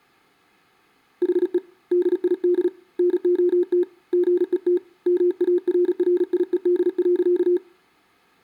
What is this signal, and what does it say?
Morse code, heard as a keyed tone, hand-sent with a paddle, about 36 wpm, 360 Hz, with room echo. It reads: HE DID NOT GET MARRIED.